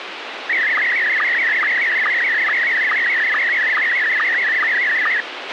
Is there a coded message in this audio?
Yes: SSTV (slow-scan television), Scottie S1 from 0.5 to 5.2 s, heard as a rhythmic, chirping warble, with radio hiss and a squelch burst at the end.